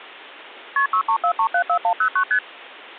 Multi-frequency trunk signalling (R1, as on North American trunks), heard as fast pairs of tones, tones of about 80 ms. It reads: KP 634374109 ST